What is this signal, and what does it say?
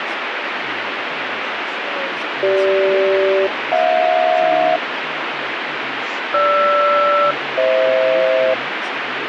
Aircraft SELCAL, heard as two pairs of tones, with radio static and speech in English. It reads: CG-HJ GR-FH